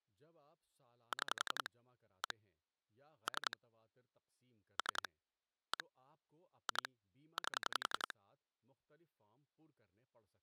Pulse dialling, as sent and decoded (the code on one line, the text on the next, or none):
6 / 1 / 3 / 3 / 1 / 2 / 8
6 1 3 3 1 2 8